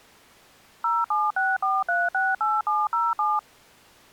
DTMF, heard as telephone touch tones, dialled by machine, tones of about 200 ms. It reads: 0764368707